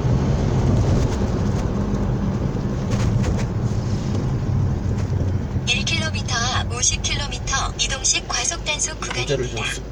The noise inside a car. There is no code.